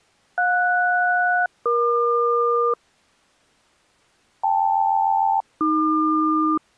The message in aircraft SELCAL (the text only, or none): JS-EQ KL-AQ